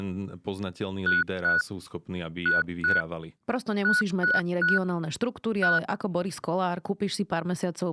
Beep code, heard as beeps, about 1470 Hz, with speech in Slovak. 2-2-3-1. In Phoenix BIOS tables: unexpected interrupt.